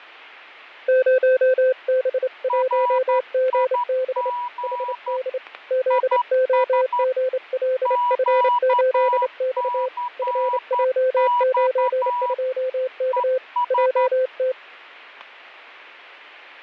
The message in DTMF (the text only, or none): none